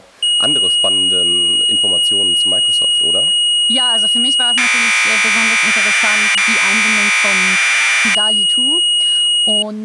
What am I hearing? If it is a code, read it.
Commodore tape loading (standard loader), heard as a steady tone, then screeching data, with speech in German.